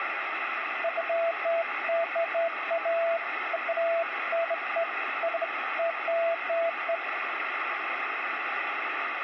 Beeps of irregular length, with radio static and room echo. There is no code.